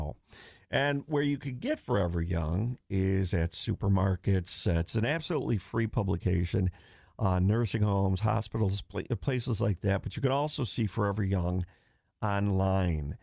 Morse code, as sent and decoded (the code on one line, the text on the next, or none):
none